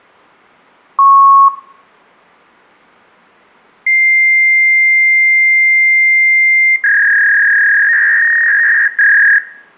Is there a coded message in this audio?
Yes: fax machine handshake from 1.0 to 9.4 s, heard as a beep, a long tone and a warble, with room echo.